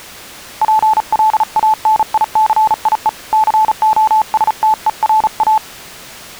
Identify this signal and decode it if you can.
Morse code, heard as a keyed tone, hand-sent with a paddle, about 36 wpm, 870 Hz. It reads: PLANICIE COSTERA